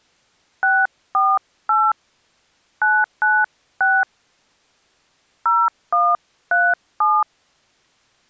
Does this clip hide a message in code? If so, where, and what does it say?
Yes: DTMF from 0.6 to 7.2 s, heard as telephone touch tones, dialled by hand, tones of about 230 ms. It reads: 648 996 0137